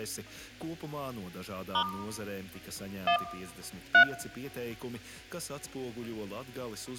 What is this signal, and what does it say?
DTMF, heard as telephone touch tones, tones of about 80 ms. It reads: * 1 3